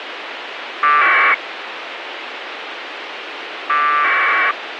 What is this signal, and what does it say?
Packet radio (AX.25, as in APRS), 1200 baud, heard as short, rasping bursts, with radio hiss.